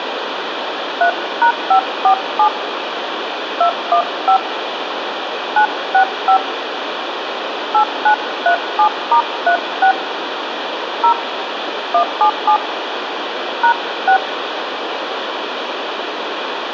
DTMF, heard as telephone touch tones, dialled by hand, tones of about 90 ms, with phone line noise. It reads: 3#547 215 965 8937*36 0 177 #6